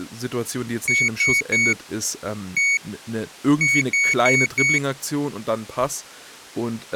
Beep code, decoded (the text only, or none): 3-1-4